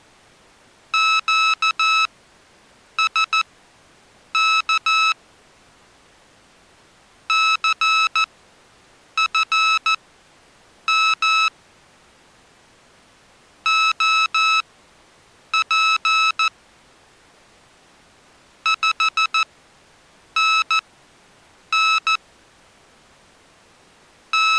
Morse code, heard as electronic beeps, machine-sent, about 14 wpm, spaced as for 7 wpm, 1300 Hz. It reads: QSK CFM OP 5NN …